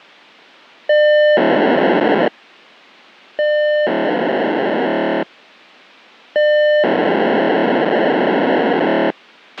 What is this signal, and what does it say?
POCSAG pager data (1200 baud), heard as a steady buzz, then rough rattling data, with a squelch burst at the end.